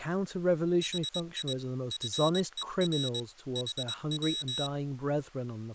Morse code, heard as a high beeper, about 22 wpm, 3850 Hz, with speech in English. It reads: HI FER HW